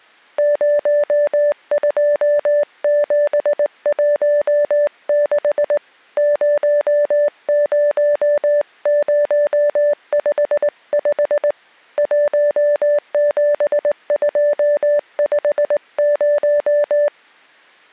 Morse code, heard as a keyed tone, hand-sent with a straight key, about 19 wpm, 590 Hz. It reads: 02716 00055 17250